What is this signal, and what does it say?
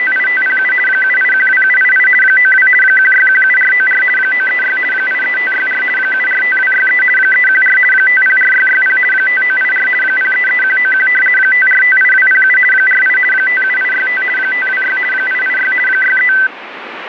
RTTY (50 baud, 450 Hz shift), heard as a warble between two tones, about 1750 Hz centre, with radio static. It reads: … 7812788 92 1617494 936 83564 745263 314 504660 5984 033191 5458207 48 57865 526 886 63